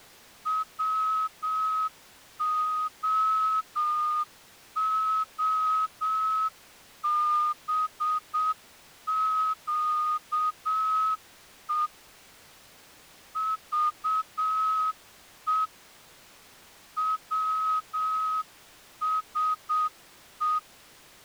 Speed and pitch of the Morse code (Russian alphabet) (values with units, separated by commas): 7 wpm